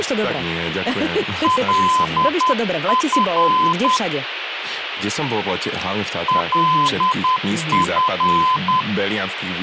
Morse code, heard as a keyed tone, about 10 wpm, 1020 Hz, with radio hiss and speech in Slovak. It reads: LF LF